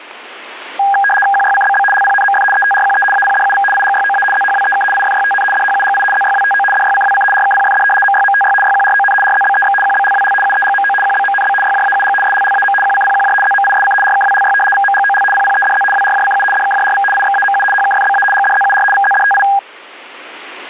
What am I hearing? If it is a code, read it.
RTTY (75 baud, 850 Hz shift), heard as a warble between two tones, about 1220 Hz centre, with radio static. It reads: QYCBB LPNMF ETRQE APDUV IGYOA ZHWEK IFYTN DHUGI ZYWTO DYCWC RKPFD MYMTY YQRON RZBEX QBLWL UEGMO QBMNB YJAUG SLLAM QCPQJ ZMISC RKWLY VMGOL PPEDZ WRJCU DKJRV IXAMU HKFBA GDZUR VZDTI